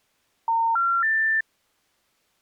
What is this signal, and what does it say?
Telephone call progress tone (North American plan), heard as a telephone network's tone, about 910, 1370, 1800 Hz. Special information tone.